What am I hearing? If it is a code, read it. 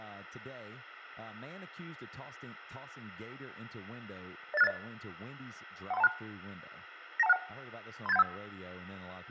Five-tone selective call (EIA), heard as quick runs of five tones, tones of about 30 ms, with a squelch burst at the end, room echo and speech in English. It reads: 08680 13126 92161 38715